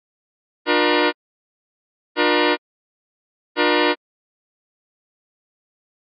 Train horn signal, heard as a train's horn. 3 short. On North American railways: when stopped, the train will back up.